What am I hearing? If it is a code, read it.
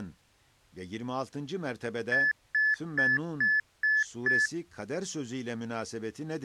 Beep code, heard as beeps, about 1750 Hz, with speech in Turkish. 6 short. In AMI BIOS tables: keyboard controller gate A20 failure; in Dell tables: video card failure.